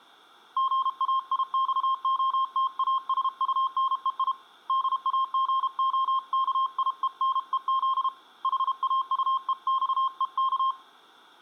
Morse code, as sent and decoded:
--. .- .. -..- --- - .- ... ..- -. . .. / -.. .- --. --- -.- .. . -. . --.. / .... .- ..- . -..- . -.-
GAIXOTASUNEI DAGOKIENEZ HAUEXEK

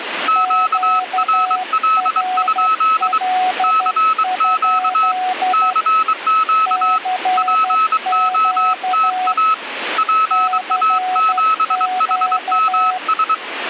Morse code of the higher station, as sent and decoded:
--.- .-. .-.. ..--.. / -.-. --.- / -.-. --.- / .--. --- - .- / .--. .- --... .... -- ...
QRL? CQ CQ POTA PA7HMS

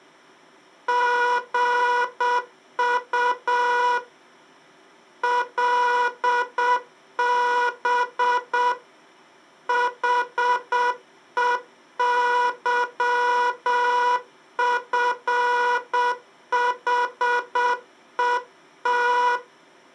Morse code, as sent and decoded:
--. ..- / .-.. -... / .... . -.-- ..-. .... . -
GU LB HEYFHET

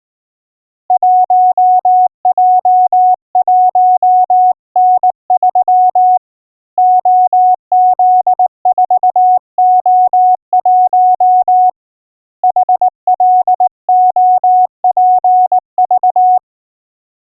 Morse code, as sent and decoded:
.---- .--- .---- -. ...-- / --- --.. ....- --- .---- / .... .-.. --- .--. ...-
1J1N3 OZ4O1 HLOPV

